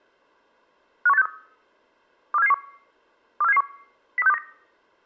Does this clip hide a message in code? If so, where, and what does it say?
Yes: five-tone selective call (EEA) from 1.1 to 4.4 s, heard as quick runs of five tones, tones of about 40 ms. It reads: 51863 24771 24771 03629